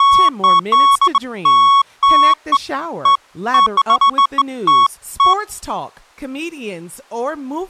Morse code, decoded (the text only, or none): none